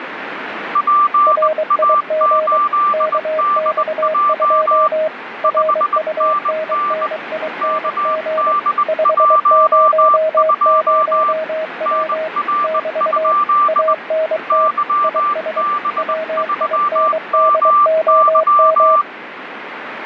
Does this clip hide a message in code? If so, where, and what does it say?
Yes: Morse code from 0.7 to 19.1 s, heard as two keyed tones, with radio static. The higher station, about 20 wpm, 1180 Hz: PA8DJ 5NN KD12 NR? YB3MY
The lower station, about 23 wpm, 630 Hz: RIG KX2 RUNNING 500W <BT> ANT IS WINDOM